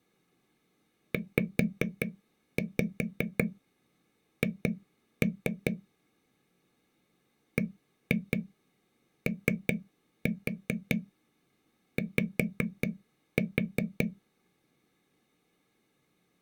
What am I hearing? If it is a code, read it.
Tap code, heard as taps on a table, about 5 knocks a second. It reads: ZH BOY